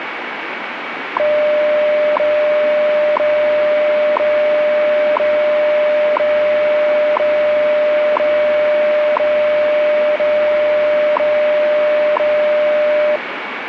Radio time signal (WWV, Colorado), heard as ticks, one a second, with radio static.